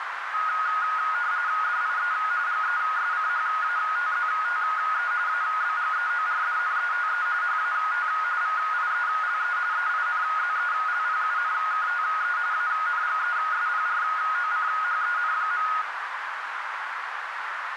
RTTY (45.45 baud, 170 Hz shift), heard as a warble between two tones, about 1350 Hz centre, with radio static and a narrow filter. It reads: DIE GESCHATZTE ABGEORDNETE HAT VIELE EINZELPUNKTE ANGESPROCHEN.